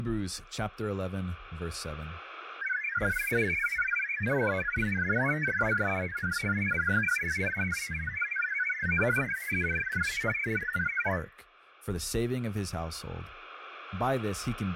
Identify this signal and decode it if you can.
Multi-tone FSK (Olivia or MFSK type), about 1000 Hz wide, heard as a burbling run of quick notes, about 62.5 baud, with speech in English.